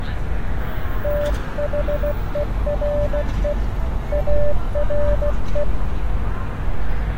Morse code, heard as a keyed tone, hand-sent with a paddle, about 16 wpm, 590 Hz, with street noise. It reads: THERE ARE